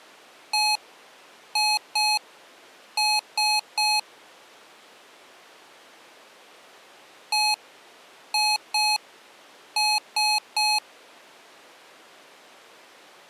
Beep code, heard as beeps from a small speaker, played twice, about 850 Hz. 1-2-3. In Phoenix BIOS tables: DMA page register failure.